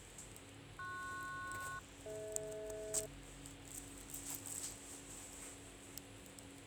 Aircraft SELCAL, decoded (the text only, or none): PS-DH